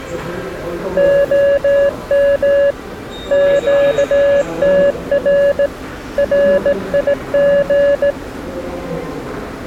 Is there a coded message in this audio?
Yes: Morse code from 0.9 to 8.2 s, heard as a keyed tone, hand-sent with a straight key, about 17 wpm, 560 Hz, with the noise of a subway station. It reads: OM QTR RIG